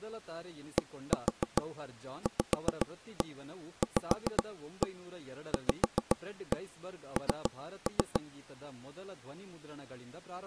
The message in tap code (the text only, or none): DVVVN